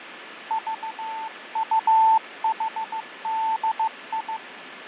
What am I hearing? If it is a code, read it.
Morse code, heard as a keyed tone, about 15 wpm, 890 Hz, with radio static and fading. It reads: VUHDI